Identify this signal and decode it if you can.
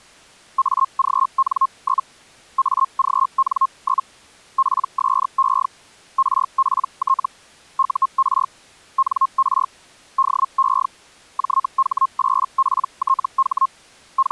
Hellschreiber (Feld-Hell, 122.5 baud), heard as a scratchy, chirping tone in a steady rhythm, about 1070 Hz. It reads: AGN? AGN? PSE RPT UR NR DE JH8PTH …